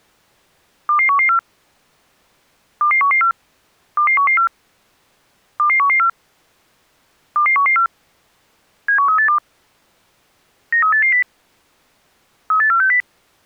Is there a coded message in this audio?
Yes: five-tone selective call (CCIR) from 0.9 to 13.0 s, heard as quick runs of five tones, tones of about 100 ms. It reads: 22114 22114 22114 22114 22114 71382 93880 38460